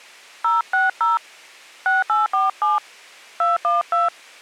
DTMF, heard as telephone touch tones, dialled by hand, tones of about 160 ms. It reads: 060 6847 212